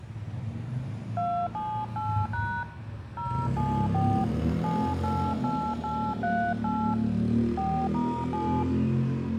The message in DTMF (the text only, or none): 278# 074 788838 4*7